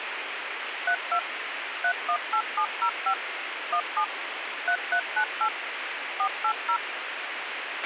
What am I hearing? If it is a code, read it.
DTMF, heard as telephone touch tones, dialled by machine, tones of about 80 ms, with radio hiss and a squelch burst at the end. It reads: 32 318705 17 3398 480